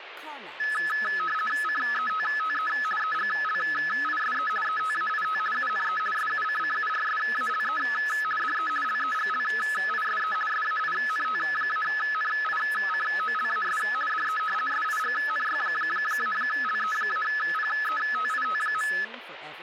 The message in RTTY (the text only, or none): CETTE EGLISE ETAIT UNE SUCCURSALE DE LEGLISE SAINT-NICOLAS DE SIGNY-LE-PETIT.